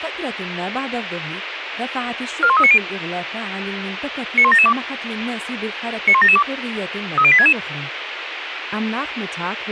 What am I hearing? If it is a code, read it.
Five-tone selective call (ZVEI), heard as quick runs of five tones, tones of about 70 ms, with radio hiss. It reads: 41390 91772 91772 30866